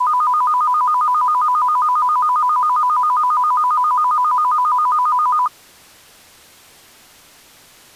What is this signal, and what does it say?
A tone that alternates evenly between two pitches. There is no code.